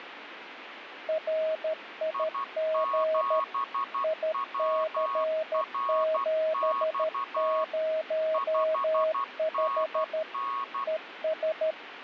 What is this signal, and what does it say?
Morse code, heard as two keyed tones, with radio static. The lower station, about 13 wpm, 630 Hz: RIG IC705 ES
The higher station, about 12 wpm, 1100 Hz: I7WRX 5NN